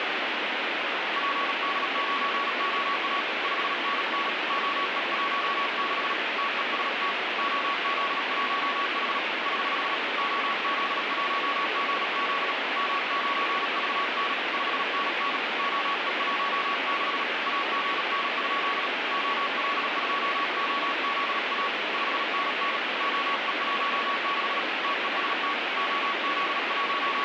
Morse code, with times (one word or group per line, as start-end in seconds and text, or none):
1.2-3.2 PD9OA
3.4-4.3 5NN
4.5-6.1 OE16
6.4-7.1 TEST
7.4-9.2 OZ1H
9.5-9.9 <HH>
10.2-12.5 OZ1GZ
12.8-14.3 M9VN
14.5-15.4 5NN
15.6-17.2 OE16
17.5-18.9 AGN?
19.1-21.7 OL2OZA
21.9-22.8 5NN
23.0-24.6 OE16
24.8-25.5 TEST
25.8-27.2 …